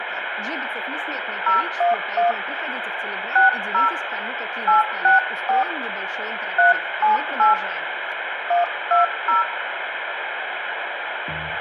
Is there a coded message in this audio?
Yes: DTMF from 1.5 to 9.4 s, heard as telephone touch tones, dialled by hand, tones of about 140 ms, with phone line noise and room echo. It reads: 011 60 864 378 120